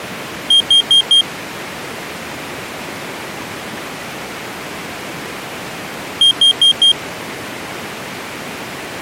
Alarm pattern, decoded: temporal four

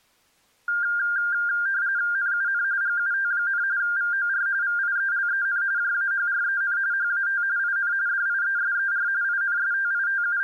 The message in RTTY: NUN GUT, VOR VIELEN JAHREN HAT IN DIESER …

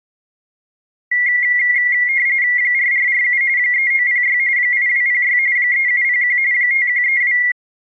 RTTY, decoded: 4447 3906 8206 3701 5132

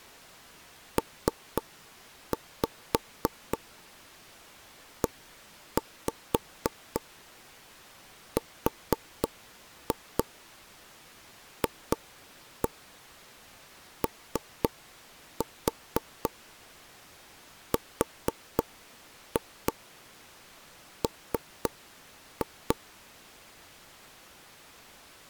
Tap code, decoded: PERFORM

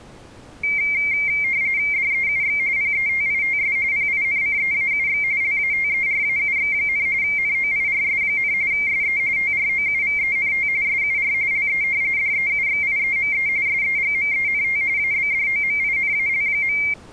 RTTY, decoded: DEUX PETITS PINCEAUX LATERAUX, NOIRS, SE TROUVENT SUR LE DEUXIEME SEGMENT ABDOMINAL.

